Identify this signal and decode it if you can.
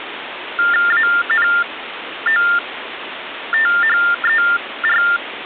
TTY/TDD text telephone tones (45.45 baud Baudot), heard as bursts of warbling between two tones, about 400 Hz shift, 1600 Hz centre, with phone line noise. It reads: ANOTHER